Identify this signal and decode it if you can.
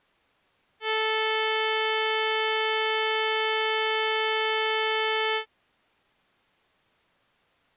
Ship horn signal, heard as a ship's horn, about 440 Hz. 1 long. At sea: a vessel nearing a blind bend, or under power and making way in fog.